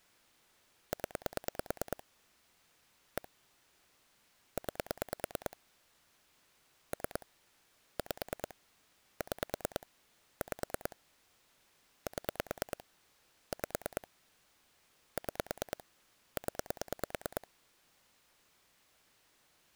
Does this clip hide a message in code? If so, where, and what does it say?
Yes: pulse dialling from 0.9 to 17.4 s, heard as clicks on a phone line, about 9 pulses a second. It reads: 0 1 9 3 5 6 5 7 5 6 0